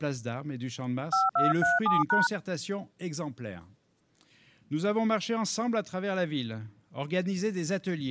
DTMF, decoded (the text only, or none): 5237#